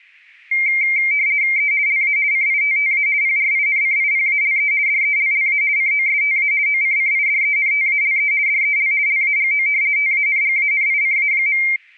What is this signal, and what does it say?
RTTY (50 baud, 170 Hz shift), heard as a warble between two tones, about 2200 Hz centre. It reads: E LA CITTA PRINCIPALE DELLA COSTA OCCIDENTALE DEL LAGO TANGANICA.